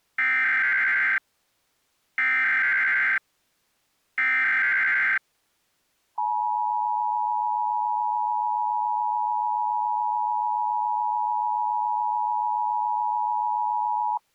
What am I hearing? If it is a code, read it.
Emergency Alert System (SAME) tones (header bursts, then the 853 and 960 Hz attention tone), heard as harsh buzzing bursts, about 520.83 baud.